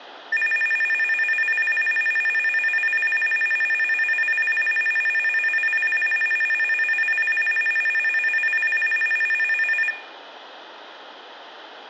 A tone that alternates evenly between two pitches, with room echo. There is no code.